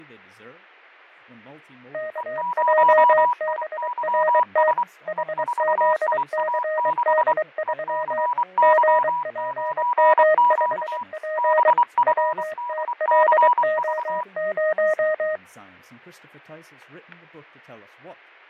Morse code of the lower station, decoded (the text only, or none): KJBRT HZCD3 GPM5P WTLO0